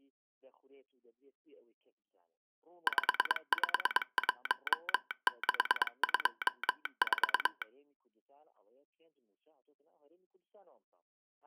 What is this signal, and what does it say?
Morse code, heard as a telegraph sounder, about 22 wpm. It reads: 551624